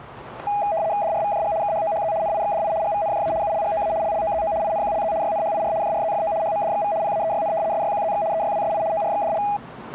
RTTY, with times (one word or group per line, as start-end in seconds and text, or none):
1.0-1.5 DRVJG
1.6-2.1 KHOHZ
2.2-2.7 NIXDI
2.8-3.3 GVNJA
3.4-3.9 ULGOA
4.0-4.5 LLOZO
4.6-5.1 INQLZ
5.2-5.7 YNHIR
5.8-6.3 JRZFO
6.4-6.9 HMDXV
7.0-7.5 PAEYN
7.7-8.2 SYQZX
8.3-8.8 EYWSI
8.9-9.4 ORXDL